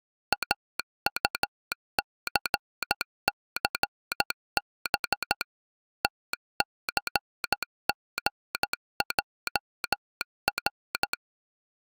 Morse code, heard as a telegraph sounder, machine-sent, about 13 wpm. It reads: AUCCB TCGJR